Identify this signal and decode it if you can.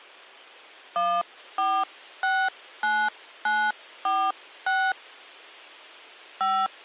DTMF, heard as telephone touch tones, dialled by hand, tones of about 260 ms. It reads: 1469946 5